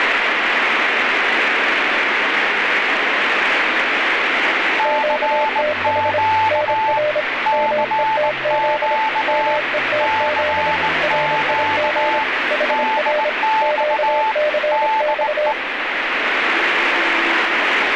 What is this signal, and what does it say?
Morse code, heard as two keyed tones, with radio static. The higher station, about 19 wpm, 880 Hz: CQ CQ CQ DX DE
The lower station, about 26 wpm, 600 Hz: QTH NR METZ METZ RIG HR QCX